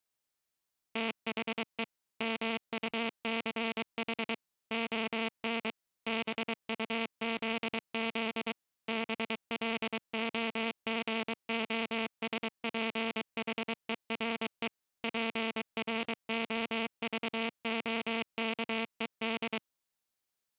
Morse code, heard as a buzzer, machine-sent, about 23 wpm. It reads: THE MUCH ON BUZZ BLOGOSPHERE PROVOKED